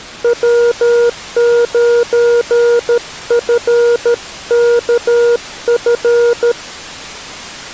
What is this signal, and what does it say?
Morse code, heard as a keyed tone, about 13 wpm, 480 Hz. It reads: W9FKF